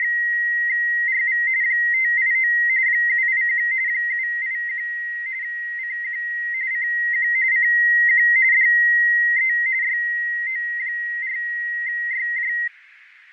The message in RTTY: … 589 781 781 CQ CQ CQ DE YO4YJ

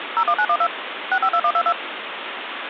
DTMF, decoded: 01912 652122

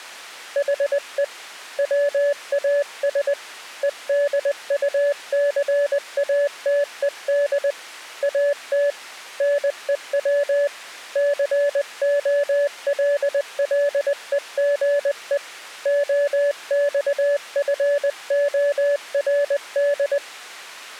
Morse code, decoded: HE WAS EDUCATED AT NEW COLLEGE OXFORD

